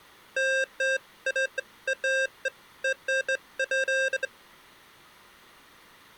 Beeps of irregular length. There is no code.